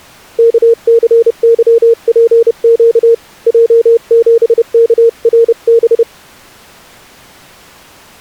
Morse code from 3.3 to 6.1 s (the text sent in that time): J7KRB